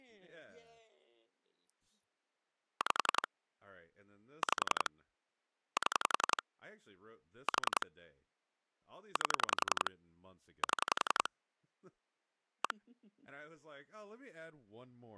Pulse dialling, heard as clicks on a phone line, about 11 pulses a second, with speech in English. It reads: 5 5 7 4 8 7 1